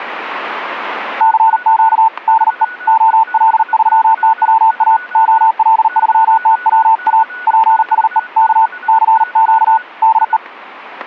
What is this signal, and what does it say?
Morse code, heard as a keyed tone, hand-sent with a paddle, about 39 wpm, 890 Hz, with static crashes and a weaker station near 1470 Hz. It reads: CQ DE OL3TWA OL3TWA PSE K CQ DE